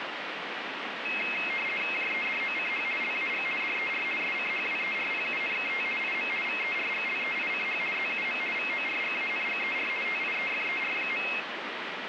RTTY (50 baud, 450 Hz shift), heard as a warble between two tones, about 2350 Hz centre, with radio static. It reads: JEDOCH LAG DER SCHWERPUNKT IM VERGLEICH ZUM VORGANGER TIEFER.